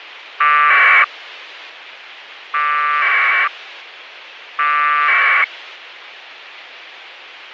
Packet radio (AX.25, as in APRS), 1200 baud, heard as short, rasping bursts, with radio hiss.